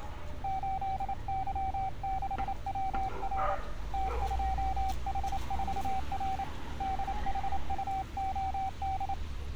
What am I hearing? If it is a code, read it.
Morse code, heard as a keyed tone, hand-sent with a paddle, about 28 wpm, 770 Hz, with street noise. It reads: 8Y6WR T2H4R DHUOD